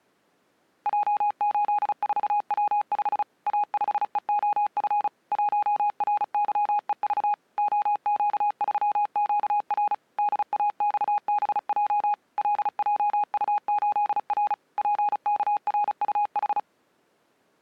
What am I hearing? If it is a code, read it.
Morse code, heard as a keyed tone, machine-sent, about 35 wpm, 830 Hz. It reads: J84W5 A5EOF 1RYEV OQ3QR DAXBJ LJU8R PKRUH